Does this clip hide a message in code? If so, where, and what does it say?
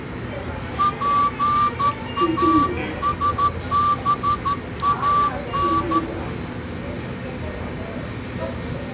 Yes: Morse code (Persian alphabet) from 0.7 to 6.0 s, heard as a whistle, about 13 wpm, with the noise of a subway station. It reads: پاسبان